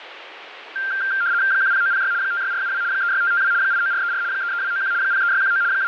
RTTY (75 baud, 170 Hz shift), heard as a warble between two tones, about 1480 Hz centre, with radio static. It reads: 10906 56472 36552 89434 33291 03619 …